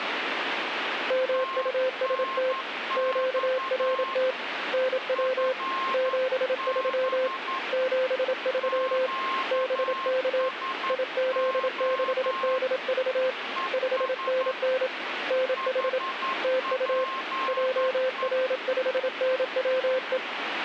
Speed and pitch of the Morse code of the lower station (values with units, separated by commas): 27 wpm, 520 Hz